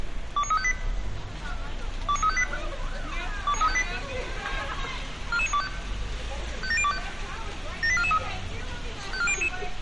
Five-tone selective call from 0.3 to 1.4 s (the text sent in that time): 29358